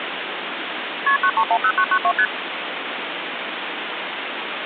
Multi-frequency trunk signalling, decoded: KP 9310992 ST

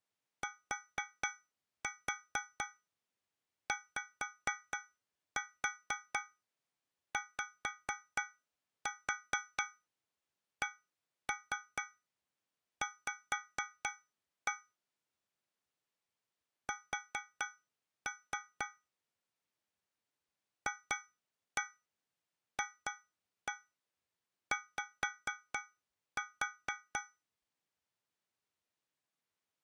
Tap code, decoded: TYYCV S FFY

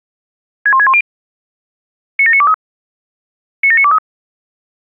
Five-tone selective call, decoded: 61610 97923 97923

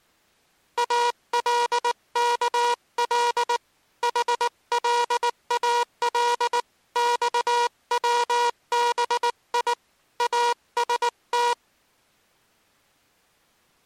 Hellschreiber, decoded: none

